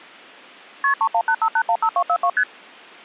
Multi-frequency trunk signalling (R1, as on North American trunks), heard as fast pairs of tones, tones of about 70 ms. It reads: KP 3185815242 ST